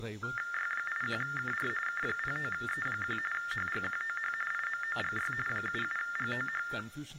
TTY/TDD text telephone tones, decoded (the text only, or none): Y81KR K09E1 HGQOH IMOGY 77GOH